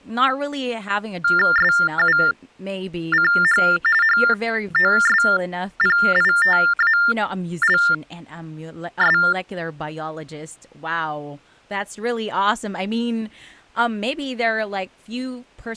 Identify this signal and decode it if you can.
TTY/TDD text telephone tones (45.45 baud Baudot), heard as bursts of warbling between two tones, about 400 Hz shift, 1600 Hz centre, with speech in English. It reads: SUCH HOSPITALS